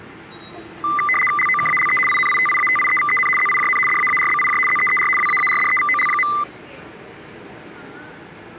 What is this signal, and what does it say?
RTTY (75 baud, 850 Hz shift), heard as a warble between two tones, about 1600 Hz centre, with the noise of a subway station. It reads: LOKALE INITIATIEVEN ZIJN DAARBIJ ZEER WAARDEVOL.